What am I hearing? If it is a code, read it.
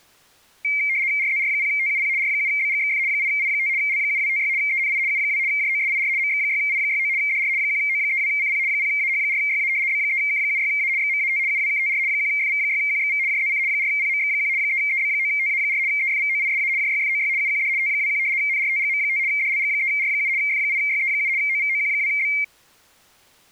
RTTY (75 baud, 170 Hz shift), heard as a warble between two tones, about 2200 Hz centre. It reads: RZR0TUP R7BGXF 8I5 L7256 ENI U2 JOSIR MX6I69 DR 1O32CP 0AH4YA B3K76A XMAT UWKTR 1FV6QXV JZC 4PMX1 3EB9TA4 EFVOISA JYFOY UQD T21 NRTGM5 DLG3R7 F8YE7 OVOQ2B